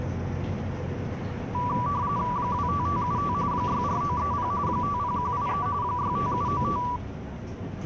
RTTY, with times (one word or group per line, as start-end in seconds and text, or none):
2.4-3.3 25575
3.5-4.5 64930
4.7-5.7 50183
5.8-6.8 65795